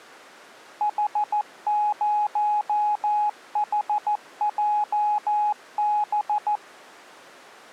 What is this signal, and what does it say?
Morse code, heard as a keyed tone, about 14 wpm, 840 Hz. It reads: H0HJB